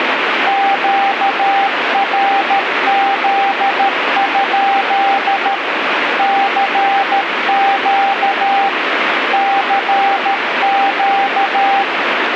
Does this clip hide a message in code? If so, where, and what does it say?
Yes: Morse code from 0.4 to 11.9 s, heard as a keyed tone, machine-sent, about 13 wpm, 790 Hz, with radio static. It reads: QRZ? CQ CQ